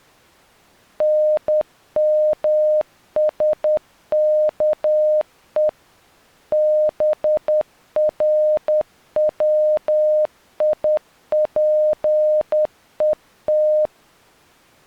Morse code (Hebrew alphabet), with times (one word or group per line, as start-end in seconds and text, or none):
1.0-5.7 נמשכו
6.5-13.9 ברציפות